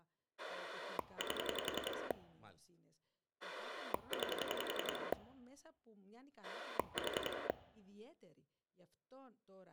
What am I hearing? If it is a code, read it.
Pulse dialling, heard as a rotary dial, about 11 pulses a second, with speech in Greek. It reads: 8 9 4